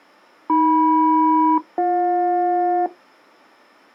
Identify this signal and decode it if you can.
Aircraft SELCAL, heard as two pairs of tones. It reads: AM-BJ